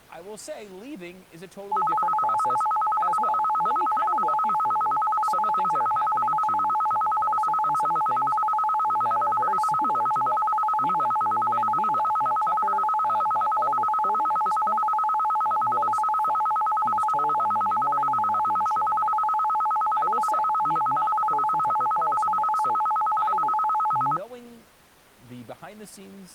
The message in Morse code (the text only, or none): none